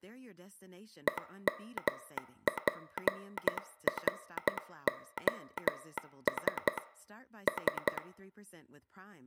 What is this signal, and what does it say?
Morse code (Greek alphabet), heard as a telegraph sounder, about 12 wpm, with room echo and speech in English. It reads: ΕΜΠΡΟΣ Σ